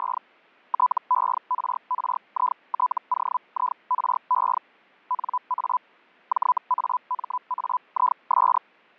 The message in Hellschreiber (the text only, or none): … TERRITOIRE NA JAMAIS